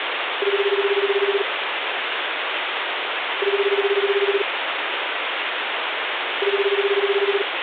Telephone call progress tone (Japanese plan), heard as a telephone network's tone, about 380, 400, 420 Hz, 1 s on and 2 s off, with phone line noise. Ringback tone.